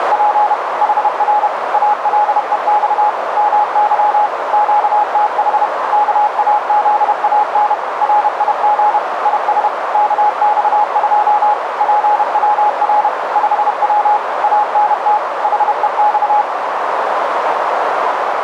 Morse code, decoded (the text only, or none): … HR ALEX MY QTH KAZAN RIG IS KX2 PWR 5W ANT HEX